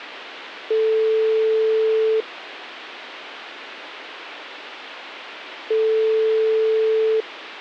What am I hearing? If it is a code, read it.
Telephone call progress tone (single-tone plan, as in most of Europe), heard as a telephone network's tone, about 440 Hz, 1.5 s on and 3.5 s off. Ringback tone.